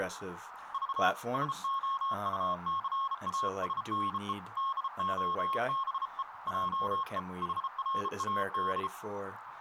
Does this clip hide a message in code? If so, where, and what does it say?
Yes: Morse code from 0.7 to 8.9 s, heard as a keyed tone, hand-sent with a bug key, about 33 wpm, 1080 Hz, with radio static, a narrow filter and speech in English. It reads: V SOUCASNE DOBE JE HRAD